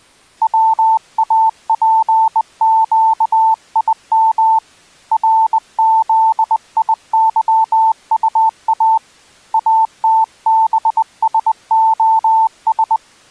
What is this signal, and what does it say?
Morse code, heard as a keyed tone, hand-sent with a bug key, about 20 wpm, 890 Hz. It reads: WAPQIM RZIYUA ATBSOS